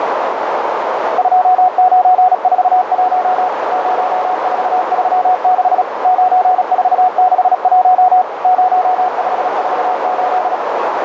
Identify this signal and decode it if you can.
Morse code, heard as a keyed tone, machine-sent, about 36 wpm, 740 Hz, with heavy radio static and a narrow filter. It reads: 2941 0436 9461 0548